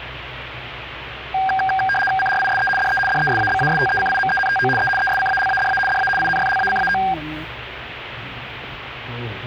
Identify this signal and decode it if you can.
RTTY (75 baud, 850 Hz shift), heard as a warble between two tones, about 1190 Hz centre, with radio static and the noise inside a car. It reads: CRISE DE DESABASTECIMENTO E ESCALADA DA INFLACAO